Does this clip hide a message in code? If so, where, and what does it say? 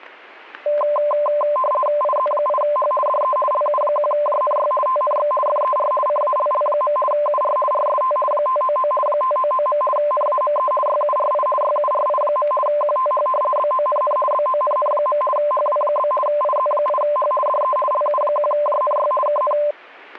Yes: RTTY (50 baud, 450 Hz shift) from 0.7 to 19.7 s, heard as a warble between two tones, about 820 Hz centre, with static crashes. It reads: IZ8H DE LU1JNY TNX FER CALL. UR RST 599 599. NAME YURI YURI. QTH BONN BONN. HW? IZ8H DE LU1JNY KN